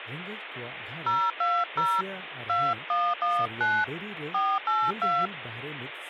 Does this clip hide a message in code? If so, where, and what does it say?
Yes: DTMF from 1.1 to 5.3 s, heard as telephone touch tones, dialled by hand, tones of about 240 ms, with phone line noise and speech in Santali. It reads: 020 2119 482